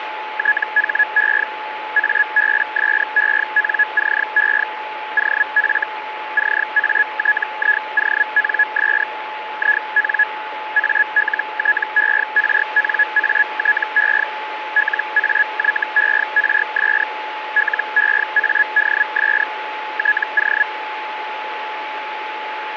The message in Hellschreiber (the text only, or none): THE ABSENCE OF CATIONS IN ALTERNATE LAYERS LEADS TO